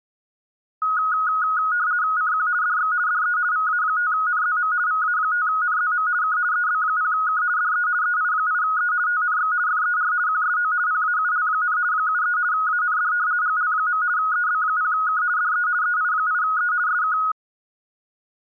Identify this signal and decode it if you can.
RTTY (50 baud, 170 Hz shift), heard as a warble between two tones, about 1360 Hz centre. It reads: CQ DX DE VA5NZM VA5NZM K EB0K DE EI8E TNX FER QSO PAUL, 73 AND GL. EB0K DE EI8E SK